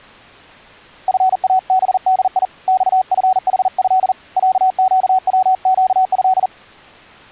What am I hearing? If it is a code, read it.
Morse code (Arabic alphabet), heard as a keyed tone, hand-sent with a paddle, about 40 wpm, 750 Hz. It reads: فابدي صفحه عقوقه